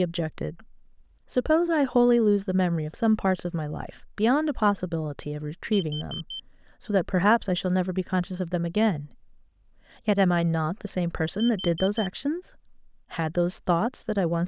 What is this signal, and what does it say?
Alarm pattern, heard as an alarm's beeps, played twice, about 3100 Hz, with speech in English. Temporal four. Carbon monoxide.